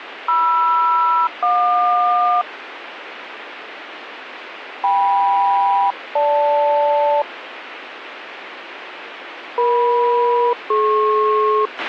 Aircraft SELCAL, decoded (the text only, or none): MR-JQ KM-GL EM-DP